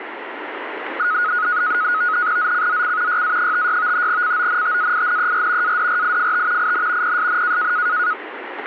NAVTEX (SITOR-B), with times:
2.4-3.2 ZCZC
3.1-4.1 YA56
4.1-5.8 CONTAINER
5.6-6.7 ADRIFT
6.6-7.2 IN
7.0-7.7 PSN

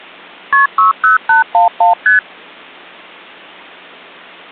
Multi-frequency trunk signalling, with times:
0.5-0.7 KP
0.8-1.9 60811
2.1-2.2 ST

